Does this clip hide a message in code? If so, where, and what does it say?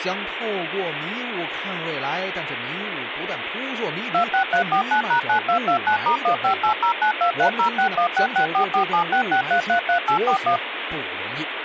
Yes: DTMF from 4.1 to 10.6 s, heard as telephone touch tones, dialled by machine, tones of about 100 ms, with phone line noise and speech in Chinese. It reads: 26349#9229*15809230616644766333841